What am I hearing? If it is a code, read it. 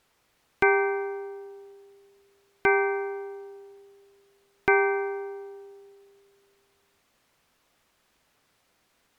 Clock strike, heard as a bell. 3. Three o'clock.